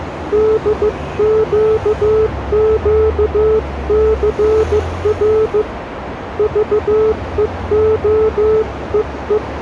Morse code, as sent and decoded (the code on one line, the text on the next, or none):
-.. --.- --.- -.-. .-. / ...- . --- . .
DQQCR VEOEE